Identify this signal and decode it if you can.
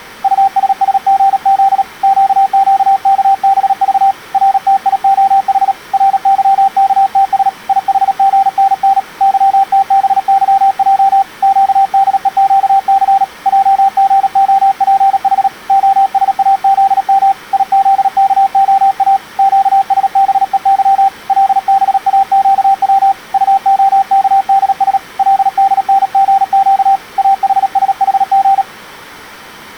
Morse code, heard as a keyed tone, hand-sent with a paddle, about 37 wpm, 780 Hz. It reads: USSGZ QQKBV RTIOH RYKTS IHGNN YTBYJ QDEQC JGOPH OSAZM IZKOA QSBEY LBAQW UOKDS LDNGQ AHSHG